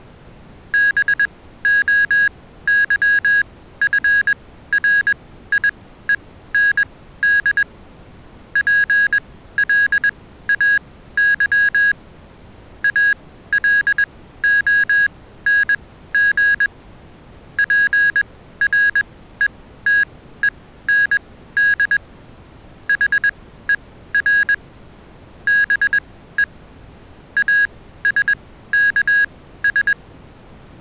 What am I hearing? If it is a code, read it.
Morse code, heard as electronic beeps, machine-sent, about 21 wpm, spaced as for 14 wpm, 1650 Hz. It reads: BOYFRIEND PLAY ALONG PRETEND HER BE ASKS